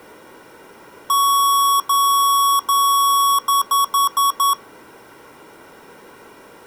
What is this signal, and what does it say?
Beep code, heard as beeps from a small speaker, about 1120 Hz. 3 long, 5 short.